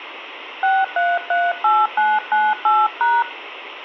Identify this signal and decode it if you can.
DTMF, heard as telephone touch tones, dialled by hand, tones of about 220 ms. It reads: 6338998#